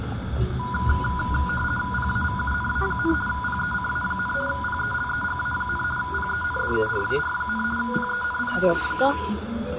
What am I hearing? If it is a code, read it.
RTTY (50 baud, 450 Hz shift), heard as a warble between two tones, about 1220 Hz centre, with radio static, room echo and the noise inside a car. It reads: PAVUNA, PECA, PELEGA, PENDURAR, PENITA,